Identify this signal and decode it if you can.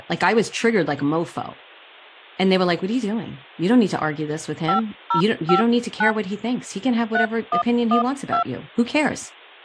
DTMF, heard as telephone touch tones, dialled by hand, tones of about 110 ms, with speech in English. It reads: 5059 3112